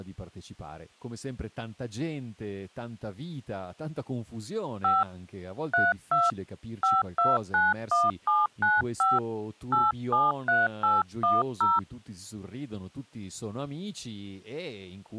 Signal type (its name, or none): DTMF